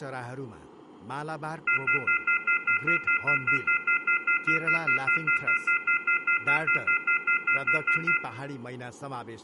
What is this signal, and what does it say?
Telephone call progress tone (North American plan), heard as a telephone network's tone, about 1400, 2050, 2450, 2600 Hz, 0.1 s on and 0.1 s off, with room echo and speech in Nepali. Off-hook warning tone.